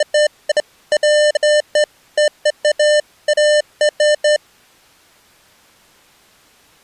Beeps of irregular length. There is no code.